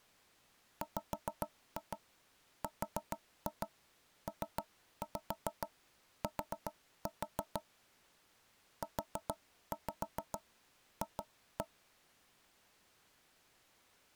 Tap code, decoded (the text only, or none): WRPT UF